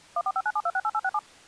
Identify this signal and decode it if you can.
DTMF, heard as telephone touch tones, dialled by machine, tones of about 50 ms. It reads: 14597268867